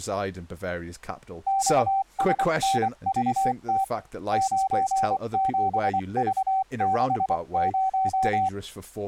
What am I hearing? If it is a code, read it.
Morse code, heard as a keyed tone, hand-sent with a paddle, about 24 wpm, 770 Hz, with speech in English. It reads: XSNVT 97V60